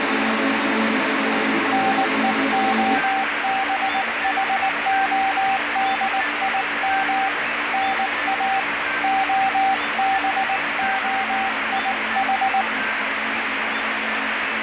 Morse code (Russian alphabet), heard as a keyed tone, hand-sent with a paddle, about 19 wpm, 780 Hz, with heavy radio static. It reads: НЕОБХОДИМ НА ОБОИХ